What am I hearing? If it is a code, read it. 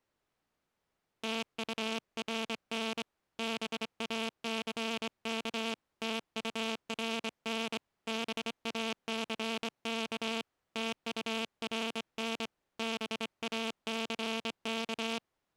Morse code, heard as a buzzer, hand-sent with a straight key, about 25 wpm. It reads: TURN BACK TURN BACK TURN BACK